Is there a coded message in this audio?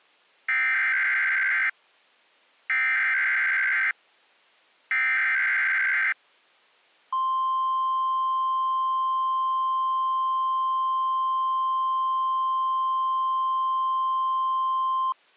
Yes: Emergency Alert System (SAME) tones (header bursts, then the 1050 Hz attention tone) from 0.5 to 15.1 s, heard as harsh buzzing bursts, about 520.83 baud.